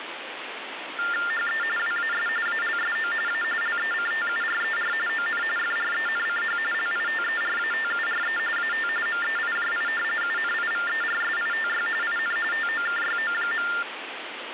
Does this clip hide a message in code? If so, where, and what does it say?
Yes: TTY/TDD text telephone tones (45.45 baud Baudot) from 1.0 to 13.8 s, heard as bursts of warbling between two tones, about 400 Hz shift, 1600 Hz centre, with phone line noise. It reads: HE WAS ALSO A LECTURER ON FRENCH LITERATURE AT MEIJI UNIVERSITY IN TOKYO.